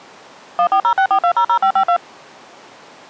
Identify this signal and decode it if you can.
DTMF, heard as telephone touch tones, dialled by machine, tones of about 80 ms. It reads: 14064200552